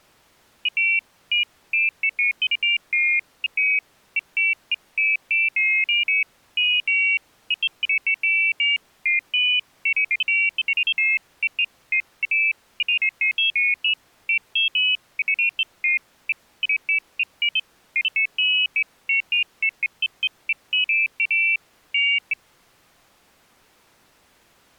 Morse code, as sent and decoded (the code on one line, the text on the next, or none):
none